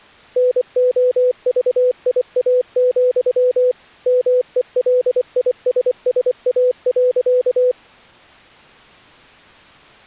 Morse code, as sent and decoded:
-. --- ...- .. .- --..-- / -- . .-.. .. ... ... .- .-.-.-
NOVIA, MELISSA.

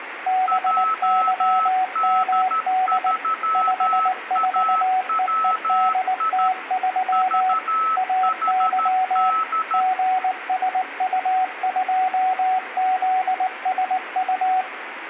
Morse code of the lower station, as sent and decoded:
-... -.-- -- -.. / ..... ....- . . -.. - ...-- / .- -.-- / --. ... ..- ..--- --.. ... ..-
BYMD 54EEDT3 AY GSU2ZSU

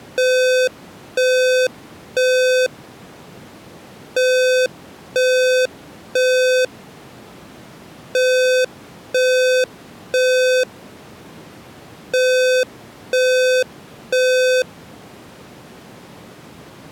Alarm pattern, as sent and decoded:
3 beeps and a pause
temporal three

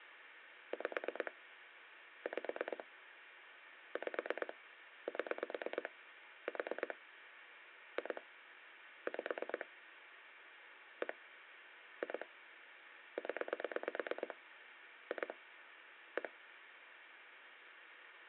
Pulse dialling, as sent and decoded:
5 / 5 / 5 / 7 / 4 / 2 / 5 / 1 / 2 / 10 / 2 / 1
5 5 5 7 4 2 5 1 2 0 2 1

